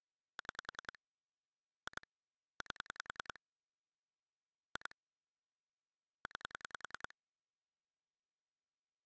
Pulse dialling, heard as clicks on a phone line, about 10 pulses a second. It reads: 6 2 8 2 9